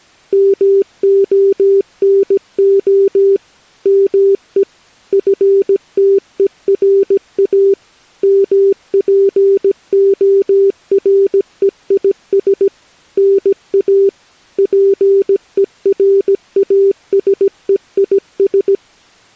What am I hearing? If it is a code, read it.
Morse code (Greek alphabet), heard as a keyed tone, machine-sent, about 17 wpm, 390 Hz. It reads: ΜΟΝΟ ΜΕ ΦΤΕΡΑ ΜΠΟΡΕΙΣ ΝΑ ΠΕΡΑΣΕΙΣ